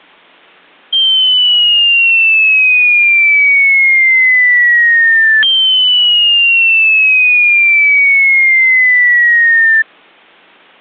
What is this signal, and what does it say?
A tone that sweeps in pitch again and again. There is no code.